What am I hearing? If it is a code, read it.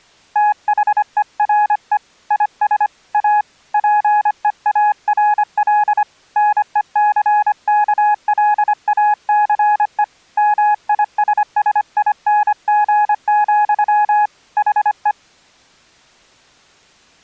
Morse code, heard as a keyed tone, hand-sent with a paddle, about 25 wpm, 840 Hz. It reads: THERE IS A PEARL NECKLACE MISSING, HE